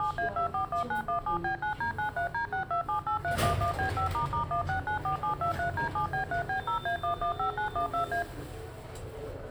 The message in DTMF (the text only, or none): 7A241917B9D93D6278311B5**1694723D7B3B0A115912A